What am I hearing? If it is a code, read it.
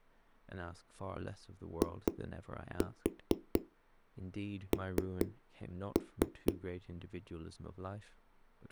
Tap code, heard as knocks on a wall, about 4 knocks a second, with speech in English. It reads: IN